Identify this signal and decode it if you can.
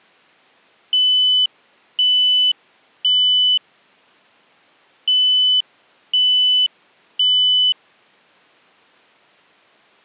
Alarm pattern, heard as an alarm's beeps, played twice, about 3000 Hz. Temporal three. Smoke or fire, evacuate.